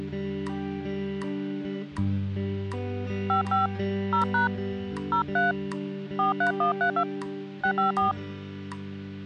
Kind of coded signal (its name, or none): DTMF